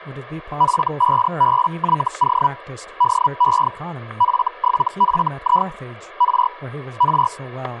Hellschreiber (Feld-Hell, 122.5 baud), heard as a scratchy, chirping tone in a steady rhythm, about 980 Hz, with static crashes and speech in English. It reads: F5BYO DE F7FI R R